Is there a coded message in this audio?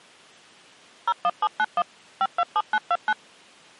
Yes: DTMF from 1.1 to 3.1 s, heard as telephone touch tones, dialled by machine, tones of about 50 ms. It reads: 01791 527929